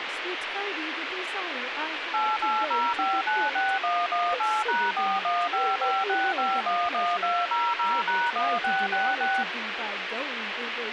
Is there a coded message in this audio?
Yes: DTMF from 2.1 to 9.4 s, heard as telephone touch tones, dialled by machine, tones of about 230 ms, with radio hiss and speech in English. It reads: 880596118#41556511200#1666